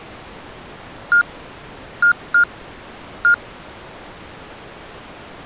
Beep code, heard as beeps from a small speaker, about 1420 Hz. 1-2-1. In Phoenix BIOS tables: interval timer failure.